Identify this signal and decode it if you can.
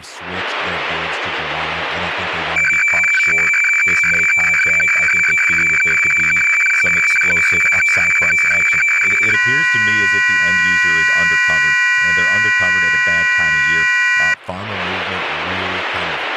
Weather fax (radiofax), 120 lines a minute, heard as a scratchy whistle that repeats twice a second, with speech in English.